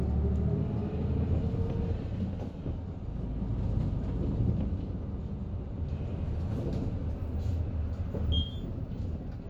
The noise inside a bus. There is no code.